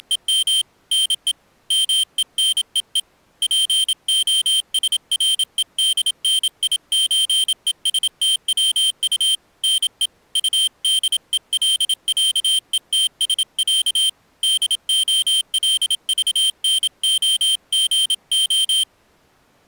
Morse code (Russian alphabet), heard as a high beeper, hand-sent with a paddle, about 27 wpm, 3150 Hz. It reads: … НЕ МЕНЕЕ ПОСРЕДНИЧЕСТВУ НЕ УДЕЛЯЕТСЯ ДОЛЖНОГО